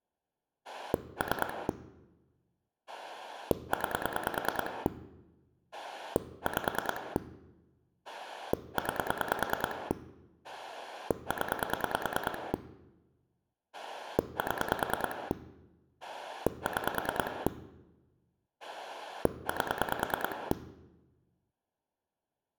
Pulse dialling, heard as a rotary dial, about 9 pulses a second. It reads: 3 9 5 9 0 7 6 8